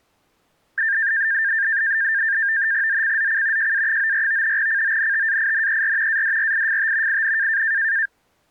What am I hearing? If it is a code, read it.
NAVTEX (SITOR-B), 100 baud, 170 Hz shift, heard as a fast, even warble, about 1700 Hz centre. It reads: ZCZC JA94 CONTAINER ADRIFT IN